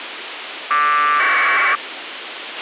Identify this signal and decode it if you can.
Packet radio (AX.25, as in APRS), 1200 baud, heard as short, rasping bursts, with radio hiss and a squelch burst at the end.